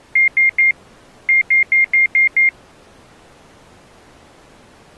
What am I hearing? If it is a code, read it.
Beep code, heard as beeps, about 2100 Hz. 3-6.